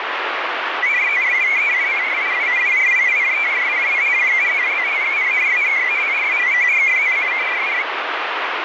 Multi-tone FSK (Olivia or MFSK type), about 500 Hz wide, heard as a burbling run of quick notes, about 62.5 baud, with radio static.